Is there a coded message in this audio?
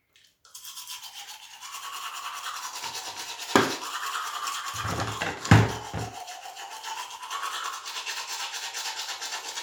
No, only the noise of a restroom.